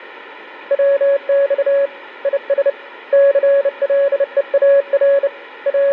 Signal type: Morse code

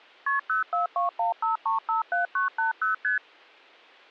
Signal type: multi-frequency trunk signalling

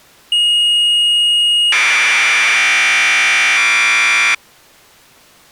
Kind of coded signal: Commodore tape loading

